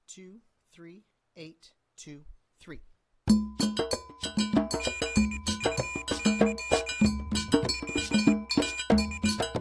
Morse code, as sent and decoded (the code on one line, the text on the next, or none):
--. ..- -.-- / .-- .- ...
GUY WAS